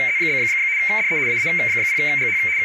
RTTY (75 baud, 170 Hz shift), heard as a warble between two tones, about 2200 Hz centre, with radio static, a narrow filter and speech in English. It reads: … DE AA0GH …